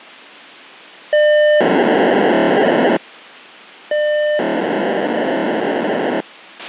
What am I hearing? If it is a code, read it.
POCSAG pager data (1200 baud), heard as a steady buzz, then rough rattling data, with a squelch burst at the end.